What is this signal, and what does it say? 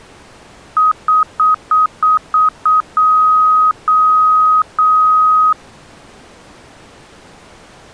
Beep code, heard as beeps, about 1260 Hz. 7 short, 3 long.